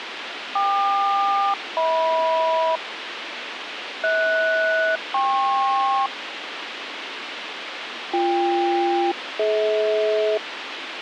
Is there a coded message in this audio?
Yes: aircraft SELCAL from 0.6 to 10.4 s, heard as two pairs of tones, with radio hiss. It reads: KQ-HM HS-KP BK-DH